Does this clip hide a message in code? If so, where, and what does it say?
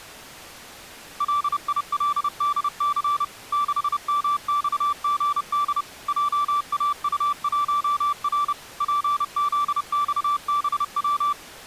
Yes: Morse code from 1.1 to 11.4 s, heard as a keyed tone, machine-sent, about 30 wpm, 1170 Hz. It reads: LILDC 6MXGD JAU1R PZXBW